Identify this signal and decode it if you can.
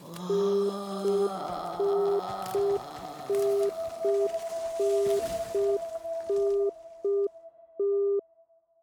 Telephone call progress tone (UK plan), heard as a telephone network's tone, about 400 Hz. Congestion tone.